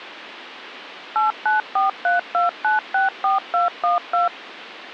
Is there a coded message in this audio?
Yes: DTMF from 1.2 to 4.3 s, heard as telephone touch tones, dialled by machine, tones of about 140 ms. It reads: 89432964212